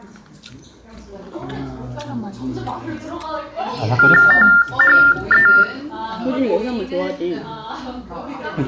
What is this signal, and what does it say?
TTY/TDD text telephone tones (45.45 baud Baudot), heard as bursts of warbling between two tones, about 400 Hz shift, 1600 Hz centre, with room echo and the noise of a restaurant. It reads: THE